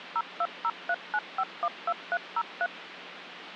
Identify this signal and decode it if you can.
DTMF, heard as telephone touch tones, dialled by machine, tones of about 50 ms, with phone line noise. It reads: 02039512303